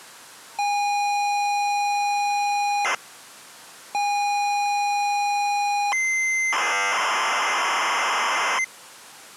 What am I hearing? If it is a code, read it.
ZX Spectrum tape loading, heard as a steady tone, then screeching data, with the noise inside a lift.